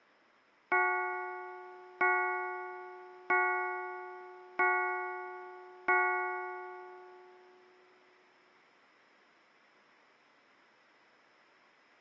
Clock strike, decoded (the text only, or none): 5